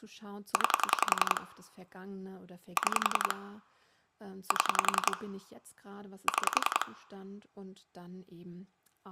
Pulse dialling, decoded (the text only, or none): 9 6 7 6